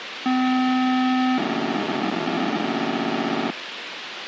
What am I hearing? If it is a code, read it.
POCSAG pager data (512 baud), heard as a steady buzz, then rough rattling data, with radio hiss.